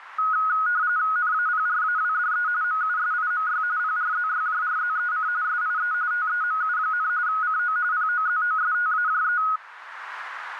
RTTY (45.45 baud, 170 Hz shift), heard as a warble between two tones, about 1360 Hz centre, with radio static. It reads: NAPRAWDE MUSIMY PRZYJRZEC SIE TEMU, CO POZOSTAJE